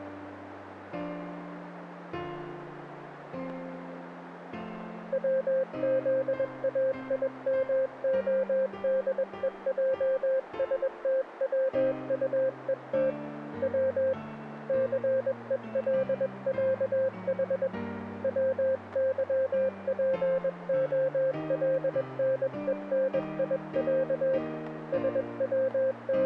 Morse code (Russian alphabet), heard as a keyed tone, hand-sent with a paddle, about 21 wpm, 530 Hz, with radio static. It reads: ВЗАИМОДЕЙСТВУЕТ В ЦЕЛЯХ ВЫПОЛНЕНИЯ …